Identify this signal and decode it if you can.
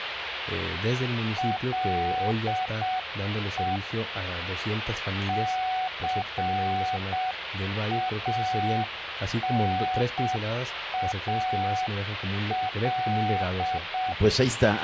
Morse code, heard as a keyed tone, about 7 wpm, 740 Hz, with radio static. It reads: LE CANAL